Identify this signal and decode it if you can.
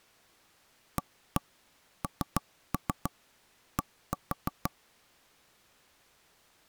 Tap code, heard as knocks on wood, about 6 knocks a second. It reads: AND